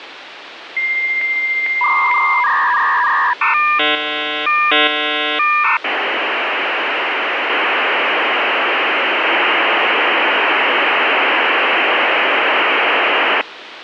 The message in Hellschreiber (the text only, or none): none